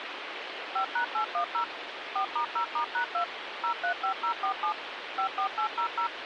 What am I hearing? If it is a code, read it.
DTMF, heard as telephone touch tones, dialled by machine, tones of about 100 ms, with phone line noise. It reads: 5#810 4*0*#2 035047 54800